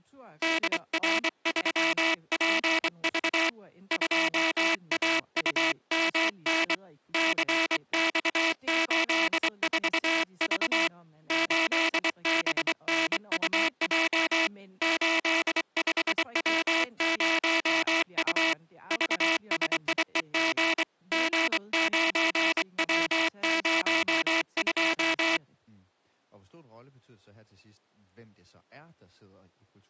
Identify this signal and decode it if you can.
Morse code, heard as a buzzer, hand-sent with a straight key, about 24 wpm, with speech in Danish. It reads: DR3PV 2AUMN CX84V 8BNUJ 85W0U VSIEG G9W02